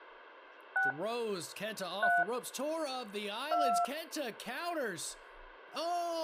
DTMF, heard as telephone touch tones, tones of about 260 ms, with speech in English. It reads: 6 3 2